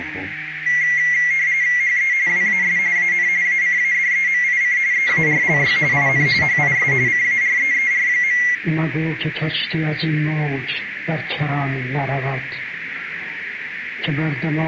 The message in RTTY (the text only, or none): HE WAS AN ACADEMIC EARLY IN HIS CAREER.